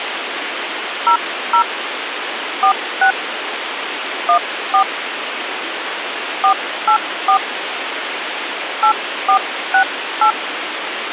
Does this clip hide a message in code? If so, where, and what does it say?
Yes: DTMF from 1.1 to 10.3 s, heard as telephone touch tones, dialled by hand, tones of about 90 ms, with phone line noise. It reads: 00 46 14 484 8468